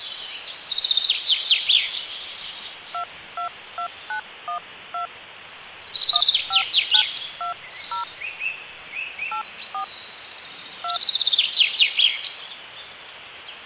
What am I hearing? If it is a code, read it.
DTMF, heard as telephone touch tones, dialled by hand, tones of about 100 ms, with phone line noise. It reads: 222912 15920 84 2